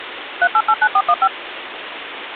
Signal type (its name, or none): DTMF